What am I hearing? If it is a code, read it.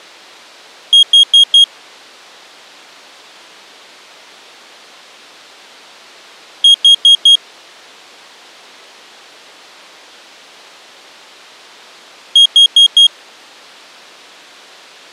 Alarm pattern, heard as an alarm's beeps, played three times, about 3250 Hz. Temporal four. Carbon monoxide.